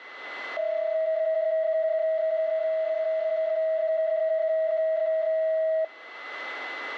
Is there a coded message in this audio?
Yes: PSK31 (31.25 baud) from 0.6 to 5.8 s, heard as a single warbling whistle, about 640 Hz, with a steady whistle near 2020 Hz.